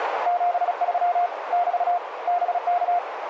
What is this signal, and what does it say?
Morse code, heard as a keyed tone, hand-sent with a paddle, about 36 wpm, 710 Hz, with radio static and a narrow filter. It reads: 73 <BT> BK